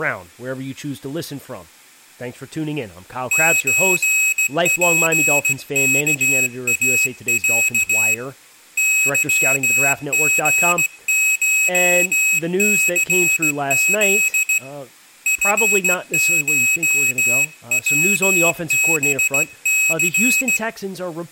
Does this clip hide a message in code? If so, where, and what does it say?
Yes: Morse code (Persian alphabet) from 3.3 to 20.6 s, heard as a high beeper, hand-sent with a straight key, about 16 wpm, 2550 Hz, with room echo and speech in English. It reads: چپکاص ظژشثز فشوبث